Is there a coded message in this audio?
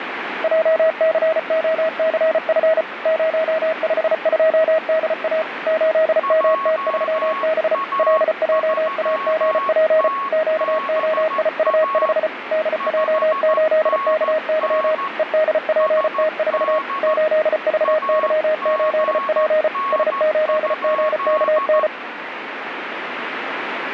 Yes: Morse code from 0.4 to 21.9 s, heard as two keyed tones, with radio static. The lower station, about 34 wpm, 630 Hz: JCOCF 052DA 8MT3B LJAGP QOIU5 DJ8KY EDPT4 8VY8P S8GKN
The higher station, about 14 wpm, 1100 Hz: JA3TBA 5NN SD AGN?